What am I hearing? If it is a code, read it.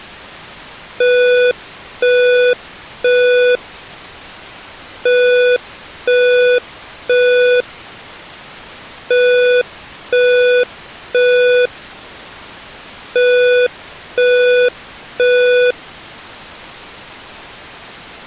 Alarm pattern, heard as an alarm's beeps, played four times, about 490 Hz. Temporal three. Smoke or fire, evacuate.